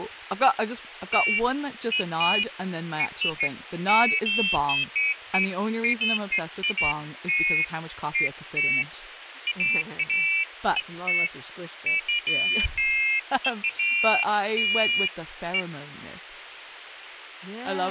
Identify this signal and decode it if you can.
Pairs of high tones at irregular times, with radio hiss, a squelch burst at the end and speech in English. There is no code.